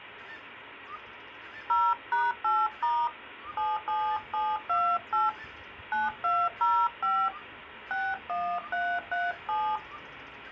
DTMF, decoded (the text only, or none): 0#8* 77728 9205 61337